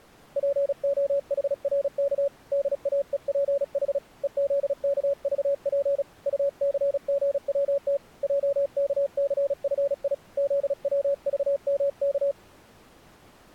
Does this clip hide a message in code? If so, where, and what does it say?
Yes: Morse code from 0.3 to 12.4 s, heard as a keyed tone, hand-sent with a paddle, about 36 wpm, 560 Hz. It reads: POHRK DAEPH EZKVP UCGWT JKCFI ZWVMK